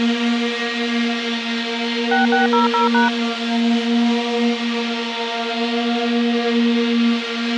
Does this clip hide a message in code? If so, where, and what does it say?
Yes: DTMF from 2.1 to 3.1 s, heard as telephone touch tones, dialled by machine, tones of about 140 ms, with radio hiss. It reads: 6600#